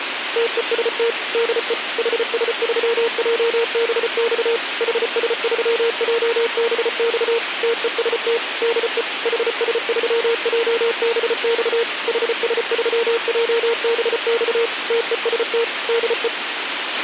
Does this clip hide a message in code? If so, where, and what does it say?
Yes: Morse code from 0.3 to 16.3 s, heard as a keyed tone, machine-sent, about 34 wpm, 460 Hz, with radio hiss and a squelch burst at the end. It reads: TEST DE HS3JBX HS3JBX TEST DE HS3JBX HS3JBX TEST DE